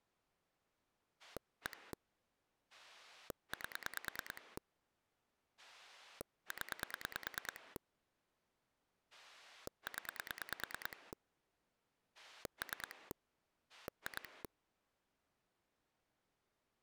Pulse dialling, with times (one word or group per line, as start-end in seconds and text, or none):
1.2-1.9 1
2.7-4.6 8
5.6-7.8 0
9.1-11.1 0
12.1-13.1 3
13.7-14.4 2